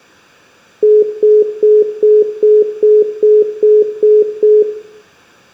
Telephone call progress tone (single-tone plan, as in most of Europe), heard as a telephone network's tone, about 420 Hz, 0.2 s on and 0.2 s off, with room echo. Congestion tone.